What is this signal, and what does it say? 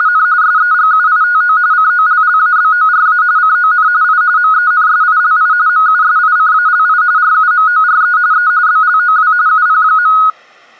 RTTY (45.45 baud, 170 Hz shift), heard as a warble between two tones, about 1360 Hz centre. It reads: … SEGUITO COLLABORA CON I MENSILI MUSICALI RUMORE E BLOW UP.